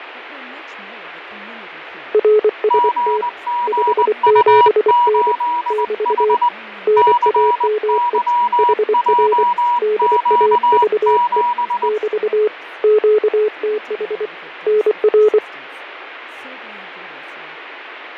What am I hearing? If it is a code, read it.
Morse code, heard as two keyed tones, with radio static, fading and speech in English. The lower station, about 24 wpm, 430 Hz: RST 57N <BT> NAME HR DAVE <BT> QTH NR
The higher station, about 20 wpm, 960 Hz: GGU8H CYJQ7